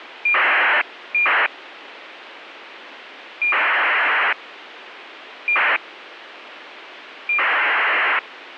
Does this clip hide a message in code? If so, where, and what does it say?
Yes: ACARS aircraft data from 0.3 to 8.2 s, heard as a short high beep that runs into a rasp, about 2400 baud, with radio hiss.